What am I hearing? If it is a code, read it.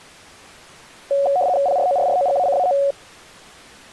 RTTY (75 baud, 170 Hz shift), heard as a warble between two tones, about 640 Hz centre. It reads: PRORROGACAO